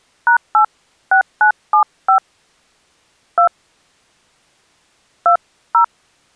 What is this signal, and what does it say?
DTMF, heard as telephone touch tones, dialled by hand, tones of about 100 ms. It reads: #86975 2 20